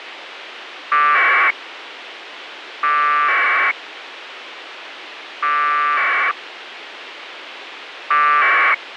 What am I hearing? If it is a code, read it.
Packet radio (AX.25, as in APRS), 1200 baud, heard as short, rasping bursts, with radio hiss.